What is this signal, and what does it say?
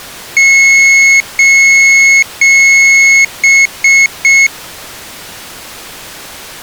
Beep code, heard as a piezo beeper, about 2200 Hz. 3 long, 3 short.